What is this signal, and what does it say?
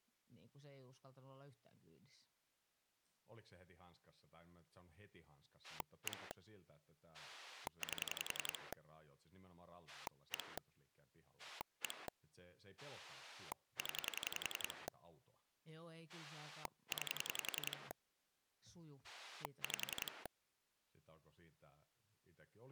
Pulse dialling, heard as a rotary dial, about 11 pulses a second, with speech in Finnish. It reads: 1 8 1 1 0 9 5